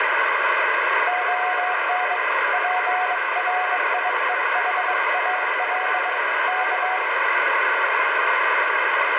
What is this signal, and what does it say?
Morse code (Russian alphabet), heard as a keyed tone, hand-sent with a bug key, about 22 wpm, 740 Hz, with radio static and room echo. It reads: ОН ПРИЕХАЛ К